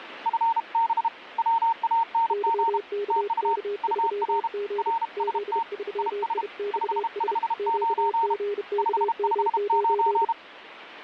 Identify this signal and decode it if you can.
Morse code, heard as two keyed tones, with radio static. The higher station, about 32 wpm, 920 Hz: FB WANG TU UR RST IS 559 559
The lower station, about 31 wpm, 410 Hz: YKK3G Z3IXS QGKM9